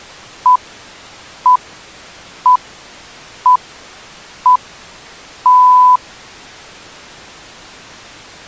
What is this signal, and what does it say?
Radio time signal (six pips, as the Greenwich Time Signal), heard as pips.